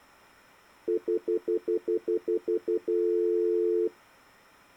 Telephone call progress tone (North American plan), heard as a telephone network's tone, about 350, 440 Hz, 0.1 s on and 0.1 s off. Stutter dial tone.